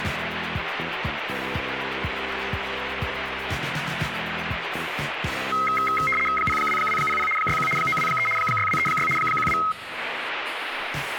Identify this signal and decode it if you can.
RTTY (75 baud, 850 Hz shift), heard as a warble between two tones, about 1700 Hz centre, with radio static. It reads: 02200 61 923 6236 12